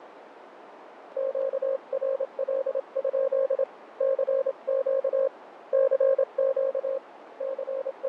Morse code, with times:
1.2-3.6 QRL?
4.0-5.3 CQ
5.7-7.0 CQ
7.4-8.1 …

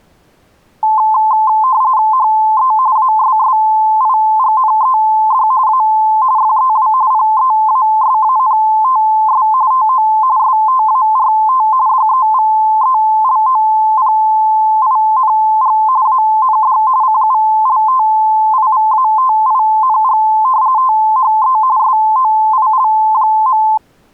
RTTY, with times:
2.1-2.7 HE
3.0-5.5 ASSIGNED
5.7-5.8 A
6.4-6.9 FEW
7.1-9.5 PEASANTS
9.7-10.1 TO
10.4-11.7 START
11.9-15.8 DEVELOPING
16.1-16.8 AND
17.0-20.2 CULTIVATING
20.8-21.6 THE
21.8-23.6 SOIL.

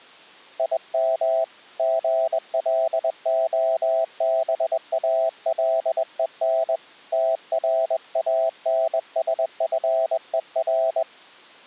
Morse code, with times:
0.6-1.4 IM
1.8-6.8 GLOBALEN
7.1-11.0 TRANSFER

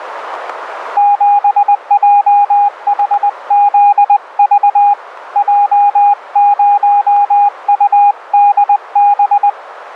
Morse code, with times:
1.0-4.9 7JHZV
5.4-9.5 J0UDB

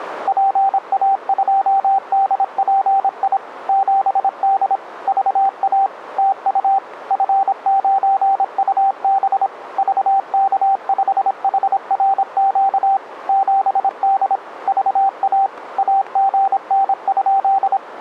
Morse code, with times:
0.3-3.4 PA2DPI
3.7-4.8 7D
5.1-5.9 VA
6.2-6.8 TU
7.1-9.5 F9UB
9.8-13.0 VK5HRQ
13.3-14.4 7D
14.7-15.5 VA
15.8-17.8 AGN?

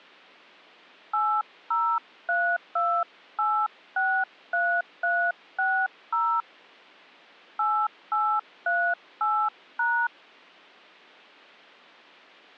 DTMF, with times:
1.1-6.4 8032863360
7.6-10.1 8838#

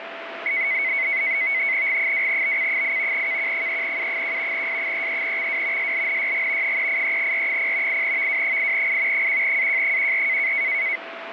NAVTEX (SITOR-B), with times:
1.9-3.3 G2BC8
3.1-4.7 KQ3U1
4.5-5.9 S33XW
5.8-6.8 SLNYG
6.6-8.0 383R0
7.9-9.3 8VW8I
9.1-10.5 1AJ14

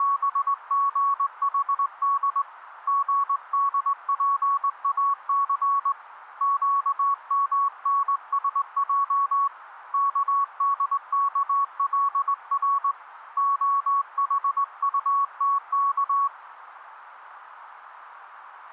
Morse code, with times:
0.0-2.4 …
2.9-5.9 GDPAC
6.4-9.5 QMNSJ
9.9-12.9 KDKLR
13.4-16.3 OHUTK

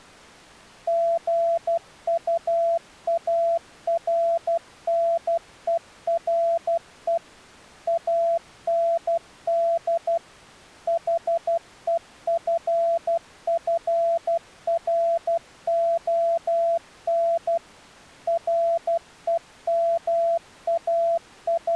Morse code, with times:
0.9-7.2 GUARNERE
7.9-10.2 AND
10.9-17.6 HEFFRON
18.3-21.8 …

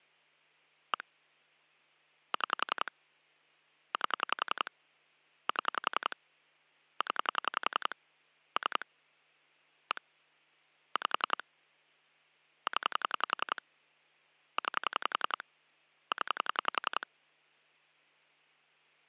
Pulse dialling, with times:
0.9-1.0 1
2.3-2.9 6
3.9-4.7 8
5.5-6.2 7
7.0-7.9 0
8.6-8.8 3
9.9-10.0 1
11.0-11.4 5
12.7-13.6 0
14.6-15.4 9
16.1-17.1 0

